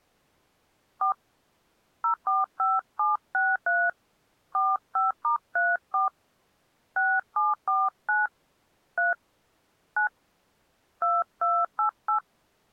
DTMF, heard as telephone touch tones, dialled by hand, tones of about 170 ms. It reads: 4 045763 45*34 6749 3 9 2288